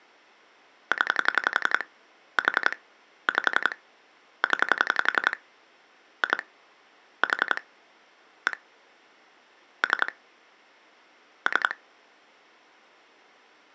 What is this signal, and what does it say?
Pulse dialling, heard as clicks on a phone line, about 11 pulses a second. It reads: 0 4 5 0 2 4 1 3 3